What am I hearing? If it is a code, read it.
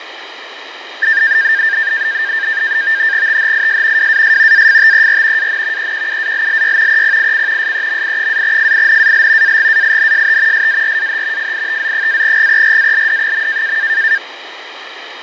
NAVTEX (SITOR-B), 100 baud, 170 Hz shift, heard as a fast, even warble, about 1700 Hz centre, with radio static and fading. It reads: THIS WAS AFTER AN EQUALLY EPIC SEMI-FINAL AGAINST SARAH FITZ-GERALD.